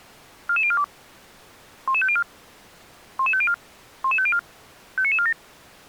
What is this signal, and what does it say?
Five-tone selective call (ZVEI), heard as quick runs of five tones, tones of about 70 ms. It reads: 44042 11504 11504 11504 59947